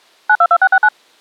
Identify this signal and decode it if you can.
DTMF, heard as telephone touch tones, dialled by machine, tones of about 60 ms. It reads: 922669